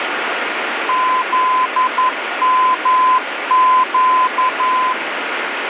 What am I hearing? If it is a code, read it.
Morse code, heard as a keyed tone, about 11 wpm, 1020 Hz, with radio static. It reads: ZMQ